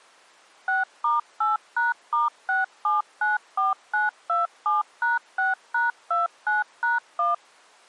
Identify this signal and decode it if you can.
DTMF, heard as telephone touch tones, dialled by machine, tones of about 160 ms. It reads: 6*8#*6794927#6#29#1